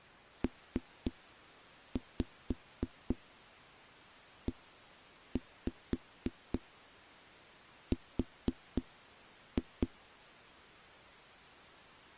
Tap code, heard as knocks on a wall, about 4 knocks a second. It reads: PER